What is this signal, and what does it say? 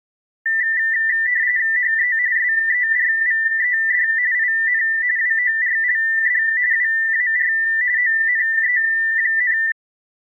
RTTY (45.45 baud, 170 Hz shift), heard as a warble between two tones, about 1900 Hz centre. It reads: HE SERVED IN WORLD WAR ONE,